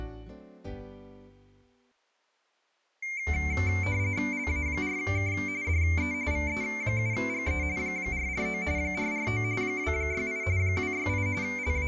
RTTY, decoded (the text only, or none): LA4K DE VE7GE 449 449 268 268 …